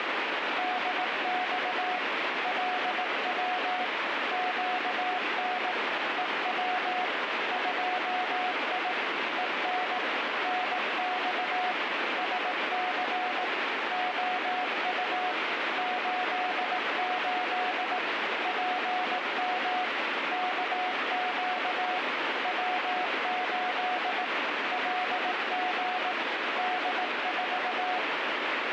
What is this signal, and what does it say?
Morse code, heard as a keyed tone, machine-sent, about 18 wpm, 730 Hz, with heavy radio static. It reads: DX LW QN EW 2I EN NX SC OU 88 PM KQ W8 LG D4